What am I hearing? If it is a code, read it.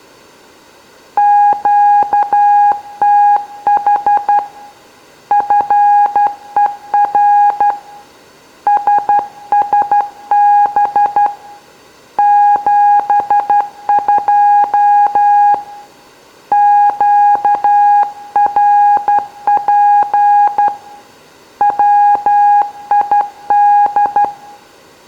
Morse code, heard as a keyed tone, hand-sent with a straight key, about 12 wpm, 820 Hz, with room echo. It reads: QTH FER SSB 72 QRP WID